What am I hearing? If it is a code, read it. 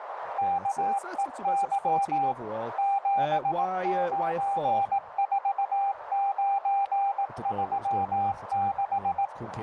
Morse code, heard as a keyed tone, machine-sent, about 18 wpm, 790 Hz, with radio static, a narrow filter and speech in English. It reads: KEY 794936